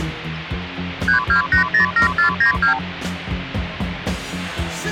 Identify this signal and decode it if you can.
Multi-frequency trunk signalling (R2, with the far end's replies), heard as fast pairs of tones, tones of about 110 ms, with phone line noise. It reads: 32807492